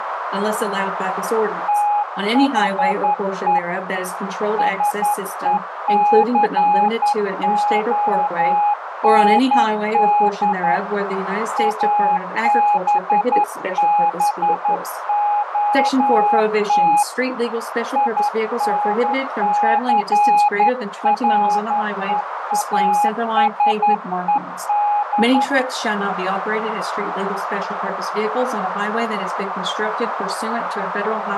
Morse code, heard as a keyed tone, hand-sent with a straight key, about 11 wpm, 830 Hz, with radio static and a narrow filter. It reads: THE SECOND ABBOT INCREASED